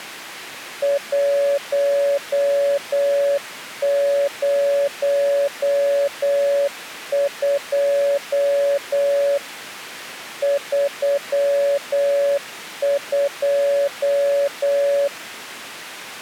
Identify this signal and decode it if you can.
Morse code, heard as a keyed tone, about 8 wpm, 560 Hz. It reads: 102 32